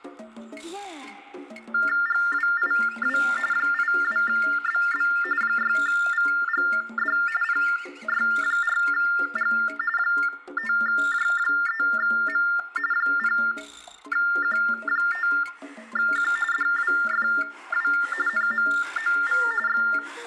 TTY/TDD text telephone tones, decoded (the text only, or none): GWIW 82BB 6VGD PY4G 5J3M 0Q5Q DWFW NMOV …